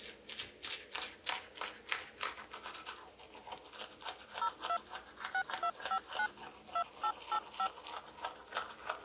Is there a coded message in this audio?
Yes: DTMF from 4.4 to 7.7 s, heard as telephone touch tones, dialled by machine, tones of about 70 ms, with the noise of a restroom. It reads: 02 6259 2885